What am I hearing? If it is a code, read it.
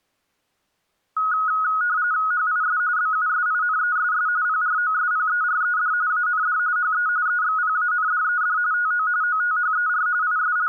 RTTY (45.45 baud, 170 Hz shift), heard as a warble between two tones, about 1360 Hz centre. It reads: HIS BUSINESS PROSPERED AND HE EXPANDED TO OTHER …